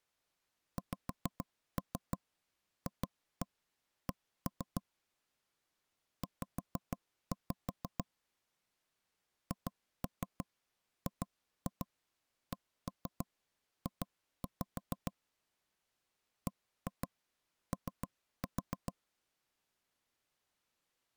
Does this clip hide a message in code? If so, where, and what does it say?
Yes: tap code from 0.8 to 18.9 s, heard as knocks on wood, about 6 knocks a second. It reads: XFC Z HGCJ BO